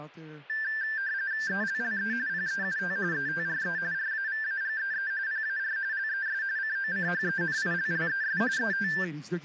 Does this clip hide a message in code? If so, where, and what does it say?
Yes: RTTY (45.45 baud, 170 Hz shift) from 0.5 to 9.0 s, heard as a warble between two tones, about 1650 Hz centre, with speech in English. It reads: ELLE PEUT ETRE RAVAGEE PAR LES COCHENILLES ET